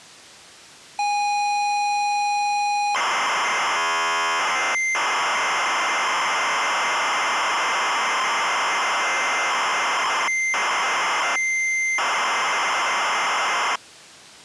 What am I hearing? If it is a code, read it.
ZX Spectrum tape loading, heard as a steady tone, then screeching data.